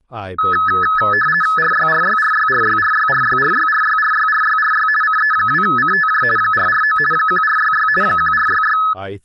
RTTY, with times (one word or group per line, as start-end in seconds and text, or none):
1.6-4.9 RYRYRYRYRYRYRYRYRYRYRY
5.0-6.2 CE2CTJ
6.4-7.0 449
7.1-7.9 1466
8.0-8.8 1466